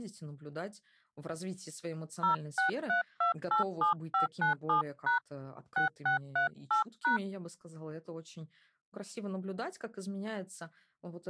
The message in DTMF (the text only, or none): 063287597# 6638#